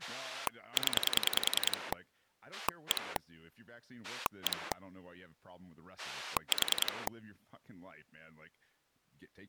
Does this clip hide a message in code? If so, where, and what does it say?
Yes: pulse dialling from 0.0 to 7.1 s, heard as a rotary dial, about 10 pulses a second, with speech in English. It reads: 0 1 1 4